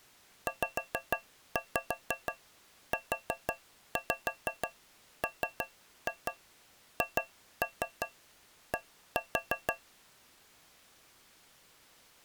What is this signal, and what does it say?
Tap code, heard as taps on a metal pipe, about 6 knocks a second. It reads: ZUMHD